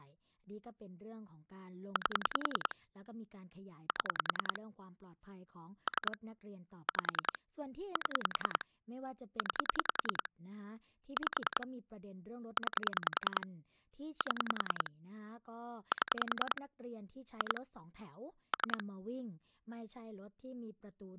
Pulse dialling, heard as clicks on a phone line, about 10 pulses a second, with speech in Thai. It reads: 8 7 3 5 7 9 5 9 7 7 2 3